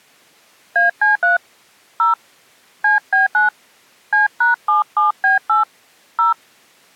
DTMF, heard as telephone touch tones, dialled by hand, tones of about 140 ms. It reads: AC3 0 CB9 C#77B8 0